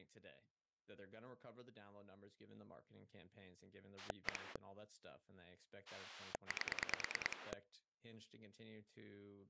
Pulse dialling, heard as a rotary dial, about 9 pulses a second, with speech in English. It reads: 1 8